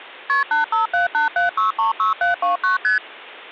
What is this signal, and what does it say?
Multi-frequency trunk signalling (R1, as on North American trunks), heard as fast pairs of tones, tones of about 130 ms. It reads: KP 85787636729 ST